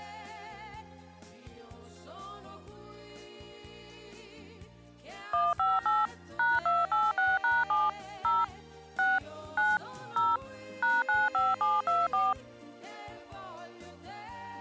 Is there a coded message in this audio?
Yes: DTMF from 5.3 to 12.3 s, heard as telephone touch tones, dialled by machine, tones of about 200 ms. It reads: 158 #286#7 0 6 9 0 #95724